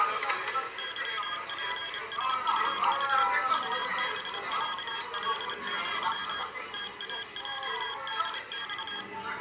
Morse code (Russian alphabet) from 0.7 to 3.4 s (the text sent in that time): ЫПСУХ